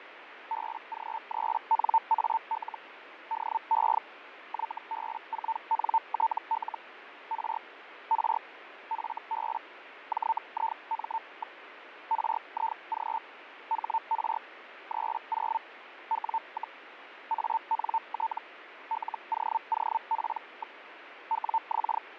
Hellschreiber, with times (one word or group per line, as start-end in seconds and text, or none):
0.5-2.8 BG3NAL
3.3-4.0 DE
4.5-6.8 YB4NTL
7.3-7.6 R
8.1-8.4 R
8.9-9.6 FB
10.1-11.6 JIM.
12.1-13.2 RIG
13.7-14.4 HR
14.9-15.6 30
16.1-16.8 W,
17.3-18.4 ANT
18.9-20.8 LOOP.
21.3-22.0 WX